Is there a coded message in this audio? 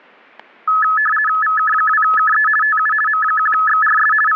Yes: RTTY (50 baud, 450 Hz shift) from 0.7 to 4.4 s, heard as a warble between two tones, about 1500 Hz centre, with static crashes. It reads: VK2KE TU M1XRS …